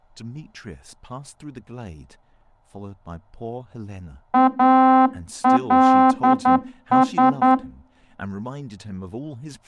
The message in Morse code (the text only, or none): ALS